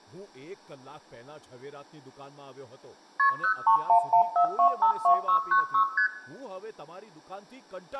Multi-frequency trunk signalling (R1, as on North American trunks), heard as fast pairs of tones, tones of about 90 ms, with room echo and speech in Gujarati. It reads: KP 03114252696 ST